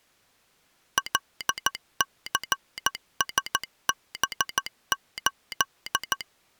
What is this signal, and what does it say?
Morse code, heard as a telegraph sounder, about 14 wpm. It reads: LCSB8